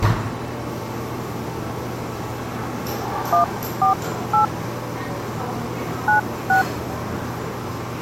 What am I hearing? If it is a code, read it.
DTMF, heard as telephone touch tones, dialled by hand, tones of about 120 ms, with the noise of a cafe. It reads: 148 96